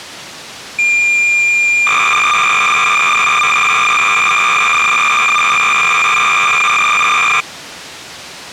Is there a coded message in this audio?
Yes: cassette data (Kansas City type), 300 baud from 0.8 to 7.4 s, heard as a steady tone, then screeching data.